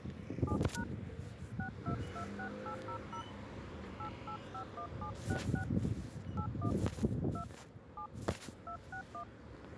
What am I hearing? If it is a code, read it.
DTMF, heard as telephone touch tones, dialled by hand, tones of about 90 ms, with the noise of a residential street. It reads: 7# 6226800 8851766 81 2 7 261